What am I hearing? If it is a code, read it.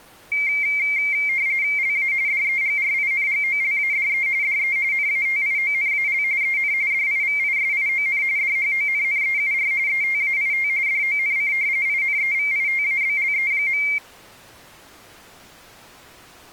RTTY (45.45 baud, 170 Hz shift), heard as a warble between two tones, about 2200 Hz centre. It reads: LA DEGRINGOLADE DE NATIONAL EN DIVISION DHONNEUR ETAIT DONC INEVITABLE.